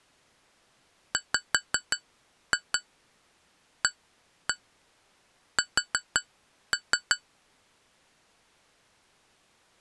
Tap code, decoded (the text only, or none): WAS